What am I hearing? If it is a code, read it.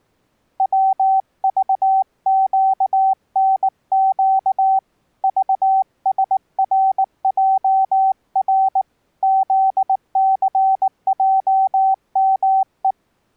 Morse code, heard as a keyed tone, hand-sent with a paddle, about 19 wpm, 770 Hz. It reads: WVQNQ VSRJR ZCJME